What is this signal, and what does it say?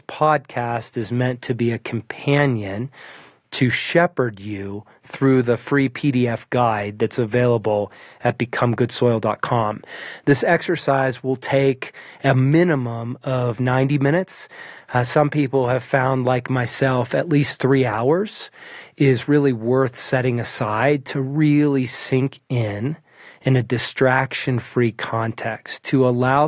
Speech in English. There is no code.